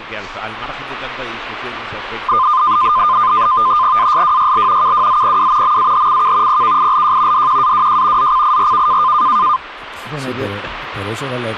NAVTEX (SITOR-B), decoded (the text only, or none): ASWYL KWZPW MAHCK PKILJ DQAWJ ZCIRK